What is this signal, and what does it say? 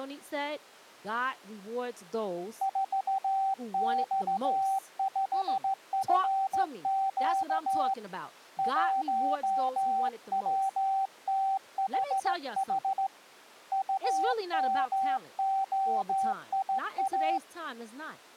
Morse code, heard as a keyed tone, hand-sent with a straight key, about 15 wpm, 780 Hz, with speech in English. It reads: 4X5FQ 1WTHH UMOIA